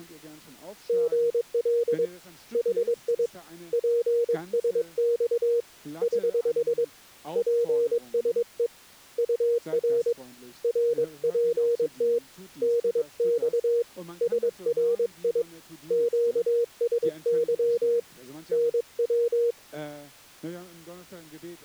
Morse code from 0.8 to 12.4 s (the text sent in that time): GL HI PSX <HH> PSE UR RPT